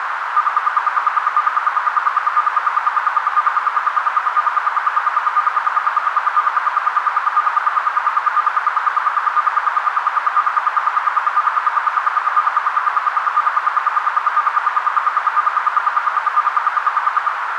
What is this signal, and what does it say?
Radio time signal (RWM, Moscow), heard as ten pulses a second, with radio static and a narrow filter.